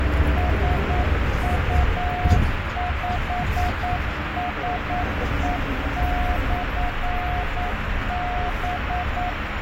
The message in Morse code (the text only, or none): SU5SE/B